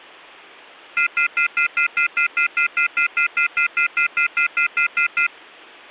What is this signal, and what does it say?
Telephone call progress tone (North American plan), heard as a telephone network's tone, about 1400, 2050, 2450, 2600 Hz, 0.1 s on and 0.1 s off. Off-hook warning tone.